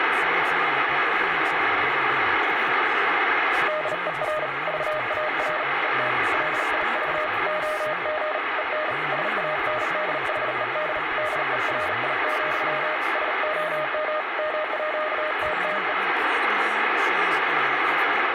Morse code (with Danish letters), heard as a keyed tone, hand-sent with a bug key, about 38 wpm, 620 Hz, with heavy radio static. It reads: DER VAR ET LIV OG EN SANDHED DERI, SOM MÅTTE